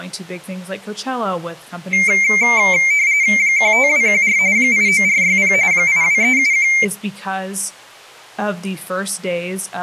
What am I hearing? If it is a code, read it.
RTTY (45.45 baud, 170 Hz shift), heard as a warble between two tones, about 2200 Hz centre, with speech in English. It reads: 15214 89460 82371